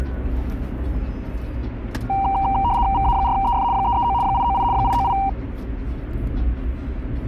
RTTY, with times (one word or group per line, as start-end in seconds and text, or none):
2.9-3.6 VA4EF
3.7-4.1 339
4.2-4.6 898
4.7-5.1 898